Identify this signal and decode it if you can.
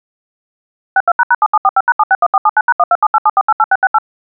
DTMF, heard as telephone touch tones, dialled by machine, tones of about 40 ms. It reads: 62##7745#761479#12787488668